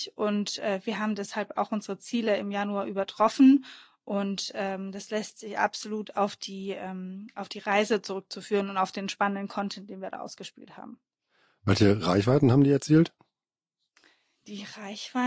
Speech in German. There is no code.